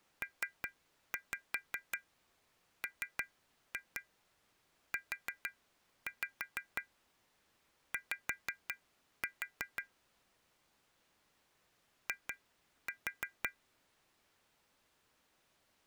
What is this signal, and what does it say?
Tap code, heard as taps on glass, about 5 knocks a second. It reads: PMUY I